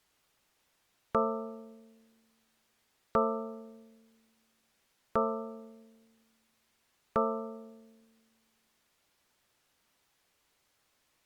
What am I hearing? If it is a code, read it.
Clock strike, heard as a bell. 4. Four o'clock.